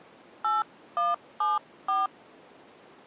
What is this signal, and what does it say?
DTMF, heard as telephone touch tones, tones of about 180 ms. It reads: 8174